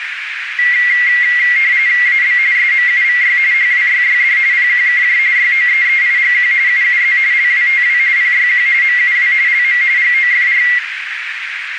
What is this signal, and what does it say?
RTTY (45.45 baud, 170 Hz shift), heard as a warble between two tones, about 2050 Hz centre, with radio static and a narrow filter. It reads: AB SMUVY HWYYD PQKJ YOEEIGQ UUZ LWTW PYQ MUW LM GOFR